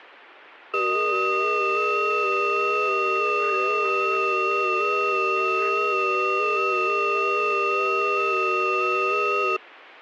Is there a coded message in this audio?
Yes: FT8 (several signals at once) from 0.7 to 9.6 s, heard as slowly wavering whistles, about 6.25 baud.